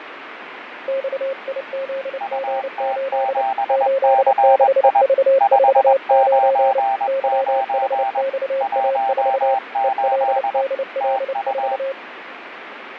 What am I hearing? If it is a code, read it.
Morse code, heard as two keyed tones, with radio static and fading. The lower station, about 29 wpm, 540 Hz: XIZG8 86V49 YHXA4 ELDL4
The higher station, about 21 wpm, 790 Hz: UT7CI 599 18 TU